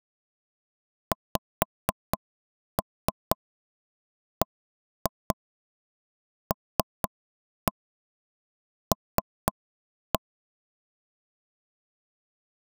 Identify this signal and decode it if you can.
Tap code, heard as taps on a table, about 4 knocks a second. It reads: XBLL